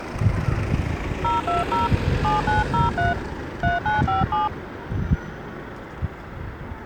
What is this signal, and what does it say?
DTMF, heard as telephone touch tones, dialled by hand, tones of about 160 ms, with the noise of a residential street. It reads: 020 7903 3957